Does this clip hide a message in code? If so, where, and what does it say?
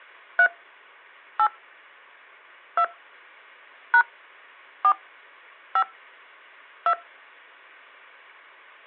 Yes: DTMF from 0.4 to 6.9 s, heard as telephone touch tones, dialled by hand, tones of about 70 ms. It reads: 3 8 2 # 4 5 2